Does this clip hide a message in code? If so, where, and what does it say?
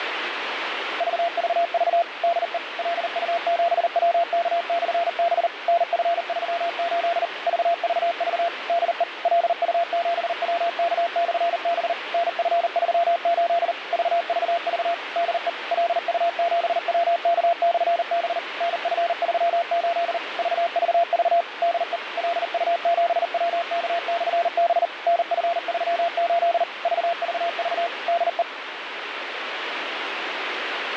Yes: Morse code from 0.9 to 28.5 s, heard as a keyed tone, machine-sent, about 39 wpm, 680 Hz, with radio static. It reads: VVV DE LU7WK/B NF38 VVV DE LU7WK/B NF38 VVV DE LU7WK/B NF38 VVV DE LU7WK/B NF38 VVV DE